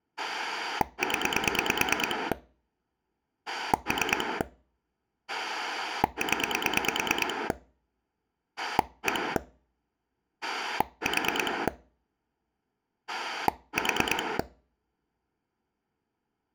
Pulse dialling, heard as a rotary dial, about 9 pulses a second. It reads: 0 3 0 1 4 4